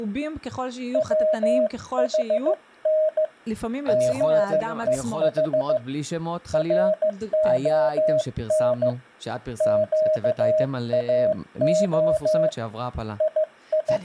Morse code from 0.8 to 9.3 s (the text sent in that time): WHN GEH RON